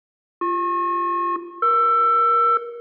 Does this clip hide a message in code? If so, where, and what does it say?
Yes: aircraft SELCAL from 0.4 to 2.6 s, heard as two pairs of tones, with room echo. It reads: BP-ER